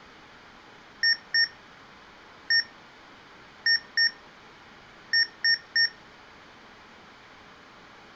Beep code, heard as beeps from a small speaker, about 1850 Hz. 2-1-2-3. In Phoenix BIOS tables: ROM copyright notice check failure.